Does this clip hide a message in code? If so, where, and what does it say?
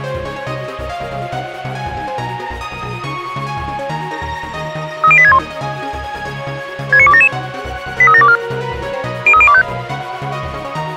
Yes: five-tone selective call (ZVEI) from 5.0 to 9.6 s, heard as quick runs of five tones, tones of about 70 ms. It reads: 30861 69277 83724 03025